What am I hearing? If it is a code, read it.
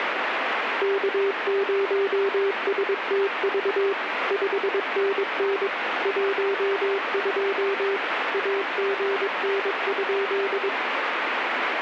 Morse code, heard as a keyed tone, machine-sent, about 22 wpm, 400 Hz, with radio static. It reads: K0STV 5NN 12 AGN?